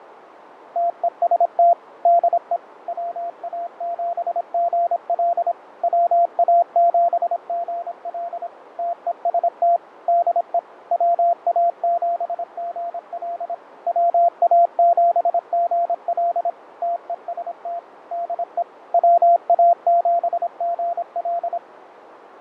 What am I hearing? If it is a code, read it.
Morse code, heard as a keyed tone, machine-sent, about 26 wpm, 690 Hz, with radio static, fading and a narrow filter. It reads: TEST DE WA7GL WA7GL TEST DE WA7GL WA7GL TEST DE WA7GL